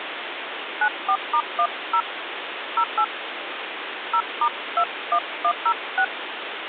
DTMF, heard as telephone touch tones, dialled by hand, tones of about 70 ms, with phone line noise. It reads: 94*10 08 0*21106